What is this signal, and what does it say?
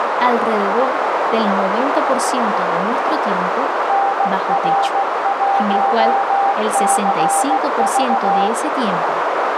Morse code, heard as a keyed tone, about 16 wpm, 790 Hz, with heavy radio static, a narrow filter and speech in Spanish. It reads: NR1CV